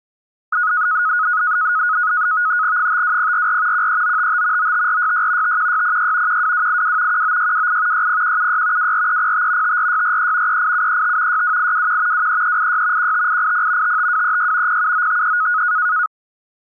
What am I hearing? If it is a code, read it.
NAVTEX (SITOR-B), 100 baud, 170 Hz shift, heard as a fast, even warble, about 1360 Hz centre. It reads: 52044 13955 95466 51606 12282 19628 60176 24305 54643 38735 62821 23386 15880 55236 07953